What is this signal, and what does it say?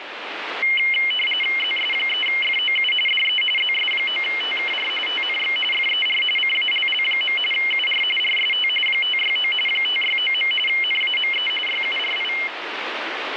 RTTY (45.45 baud, 850 Hz shift), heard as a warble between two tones, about 2550 Hz centre, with radio static. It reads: ZS3FOU DE ZS9TKR TNX FER CALL. UR RST 569 569. NAME YURI